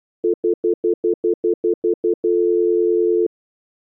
Telephone call progress tone (North American plan), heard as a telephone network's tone, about 350, 440 Hz, 0.1 s on and 0.1 s off. Stutter dial tone.